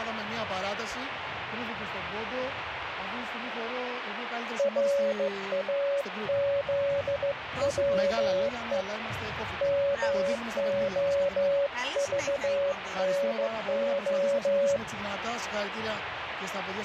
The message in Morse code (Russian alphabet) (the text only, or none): РАЗВЕ МОЖНО